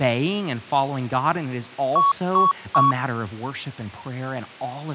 Beep code, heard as beeps, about 1120 Hz, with speech in English. 3 short. In AMI BIOS tables: failure in the first 64 KB of memory; in Dell tables: chipset error.